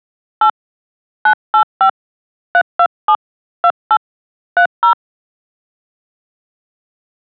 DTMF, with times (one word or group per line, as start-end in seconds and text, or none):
0.4-0.5 8
1.3-1.9 985
2.5-3.2 327
3.6-4.0 28
4.6-4.9 30